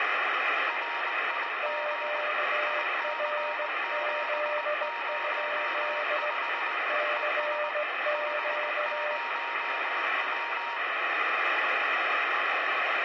Morse code, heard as two keyed tones, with radio static. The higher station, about 20 wpm, 940 Hz: RIG IC705 ES 50W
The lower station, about 18 wpm, 600 Hz: QRZ? CQ